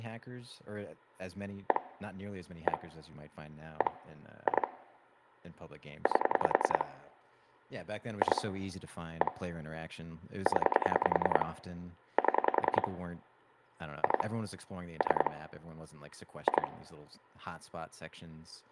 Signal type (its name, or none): pulse dialling